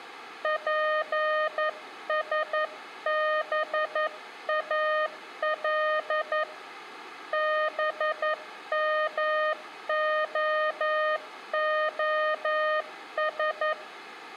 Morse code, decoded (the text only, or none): PSBAL BMOOS